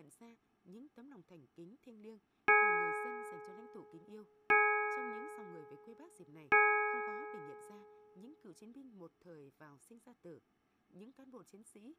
Clock strike, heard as a bell, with speech in Vietnamese. 3. Three o'clock.